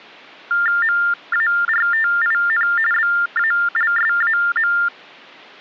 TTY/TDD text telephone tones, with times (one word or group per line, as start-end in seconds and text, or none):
0.8-2.7 MARTIN
2.9-4.7 BALSAM